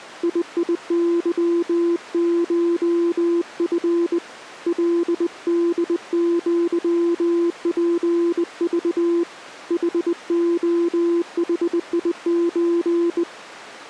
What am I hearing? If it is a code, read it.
Morse code (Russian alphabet), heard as a keyed tone, hand-sent with a bug key, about 20 wpm, 340 Hz. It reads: ИИЫШФ ЛДЪПЖ ХОХИЧ